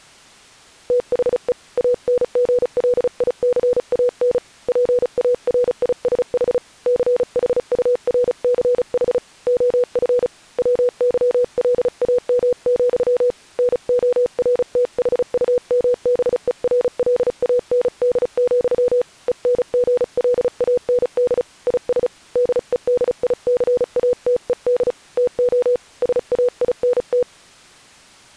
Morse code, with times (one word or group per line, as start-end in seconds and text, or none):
0.9-1.5 THE
1.8-4.4 ANGLICAN
4.7-6.6 PARISH
6.9-9.2 CHURCH
9.5-10.3 OF
10.6-13.3 WYLAM,
13.6-19.0 NORTHUMBERLAND,
19.3-21.4 ENGLAND
21.7-22.1 IS
22.4-24.9 DEDICATED
25.2-25.8 TO
26.0-27.2 SAINT